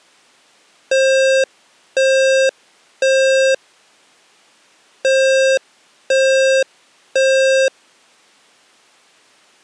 Alarm pattern, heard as an alarm's beeps, played twice, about 530 Hz. Temporal three. Smoke or fire, evacuate.